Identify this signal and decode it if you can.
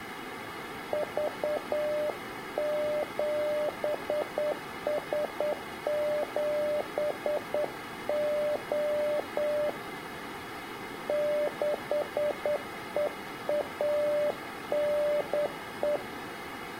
Morse code, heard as a keyed tone, hand-sent with a straight key, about 9 wpm, 600 Hz. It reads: V7S7O 6EANE